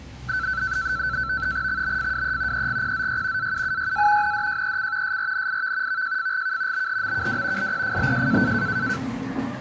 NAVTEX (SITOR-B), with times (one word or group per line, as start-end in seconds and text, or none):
1.7-2.7 XBFWE
2.5-3.5 EGPZY
3.4-4.3 AUUYA
4.2-5.2 NDJEC
5.0-6.0 SRNIV
5.9-6.9 VJFGK
6.7-7.7 BHMKW
7.6-8.5 LPFBJ